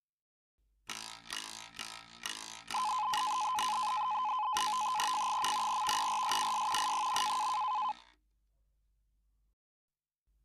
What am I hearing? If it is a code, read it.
NAVTEX (SITOR-B), 100 baud, 170 Hz shift, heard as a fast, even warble, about 940 Hz centre. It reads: F. VERSUS I.